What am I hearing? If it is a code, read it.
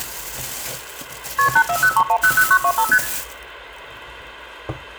Multi-frequency trunk signalling (R1, as on North American trunks), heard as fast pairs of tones, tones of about 70 ms, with room echo and kitchen noise. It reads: KP 8403100925 ST